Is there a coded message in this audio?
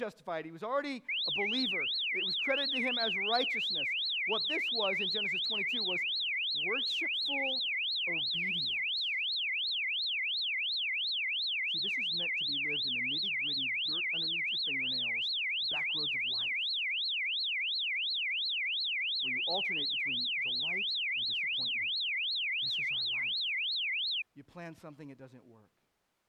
No, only a tone that sweeps in pitch again and again, with speech in English.